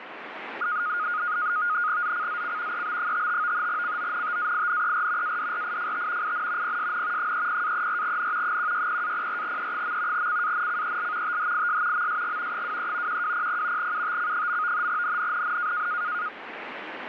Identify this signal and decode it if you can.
NAVTEX (SITOR-B), 100 baud, 170 Hz shift, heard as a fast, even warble, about 1340 Hz centre, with radio static. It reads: ZCZC EB55 CONTAINER ADRIFT IN PSN 30-34N 160-04E. CANCEL THIS MSG 23 1200 UTC. NNNN